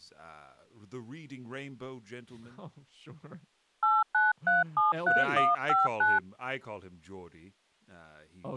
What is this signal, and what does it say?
DTMF, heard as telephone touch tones, dialled by hand, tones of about 180 ms, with speech in English. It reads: 89373159